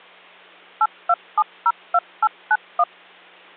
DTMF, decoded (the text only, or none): 82702891